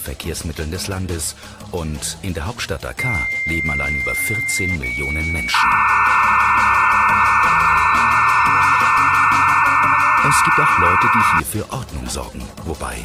Dial-up modem handshake (low-speed, two carriers), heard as two whistles, then hiss.